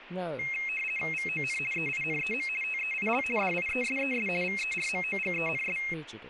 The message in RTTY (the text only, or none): VON EINEM TEIL DIESES VERMOGENS